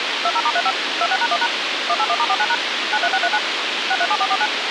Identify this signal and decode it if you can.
DTMF, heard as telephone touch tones, dialled by machine, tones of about 50 ms, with radio hiss. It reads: 20*35 26#1# 181*49# 93639 637449